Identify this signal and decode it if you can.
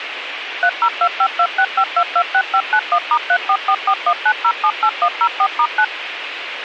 DTMF, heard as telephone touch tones, dialled by machine, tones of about 70 ms, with radio hiss. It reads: 3025265226591*344419078104*9